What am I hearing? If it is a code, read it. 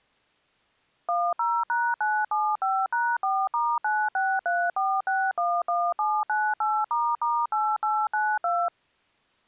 DTMF, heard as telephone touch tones, dialled by machine, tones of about 240 ms. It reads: 10#975#4*9634611798**8892